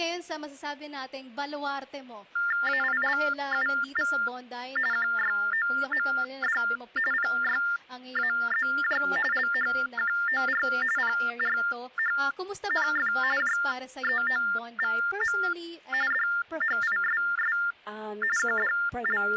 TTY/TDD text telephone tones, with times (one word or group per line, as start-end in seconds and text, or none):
2.7-4.1 AILUV
4.9-6.6 QYOMD
7.1-9.0 PYAZJ
9.3-10.6 LHQOR
11.0-13.1 PRHNF
13.4-15.4 JEOVM
16.1-17.6 DHISS
18.4-19.4 …